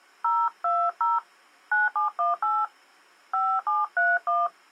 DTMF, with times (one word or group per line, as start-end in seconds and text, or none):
0.2-1.2 020
1.7-2.6 9718
3.3-4.5 5731